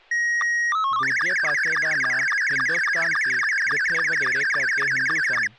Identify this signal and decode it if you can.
SSTV (slow-scan television), Scottie S2, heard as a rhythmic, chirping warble, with speech in Punjabi.